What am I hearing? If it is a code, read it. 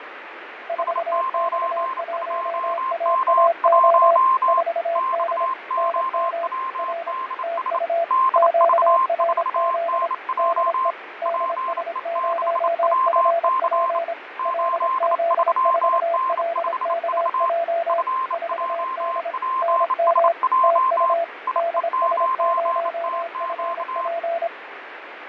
Morse code, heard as two keyed tones, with radio static and fading. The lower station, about 26 wpm, 680 Hz: 4X1AAO 4D NM R TU QRZ DE DS0FP LZ4LKJ 4D NM TU DS0FP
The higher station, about 28 wpm, 1050 Hz: S92M1 XOWDS DV4NJ PE6WC 83N5V FJPSJ IE9TQ